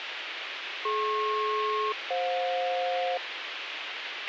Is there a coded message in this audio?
Yes: aircraft SELCAL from 0.8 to 3.2 s, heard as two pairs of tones, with radio hiss and a squelch burst at the end. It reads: DP-FJ